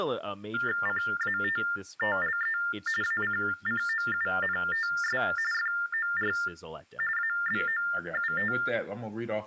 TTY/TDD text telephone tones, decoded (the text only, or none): CATTLE ACCOUNTS FOR ABOUT